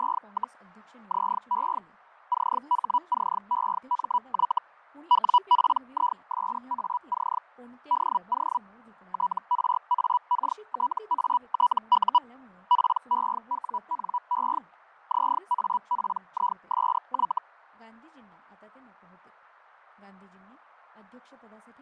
Hellschreiber (Feld-Hell, 122.5 baud), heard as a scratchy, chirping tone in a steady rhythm, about 980 Hz, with fading and speech in Gujarati. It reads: … ZE CHCEMY WPISAC DO TRAKTATU PEWNE ZAPISY